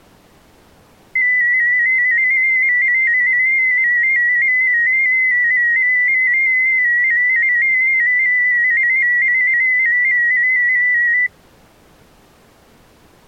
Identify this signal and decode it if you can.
Multi-tone FSK (Olivia or MFSK type), about 250 Hz wide, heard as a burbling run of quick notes, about 15.625 baud.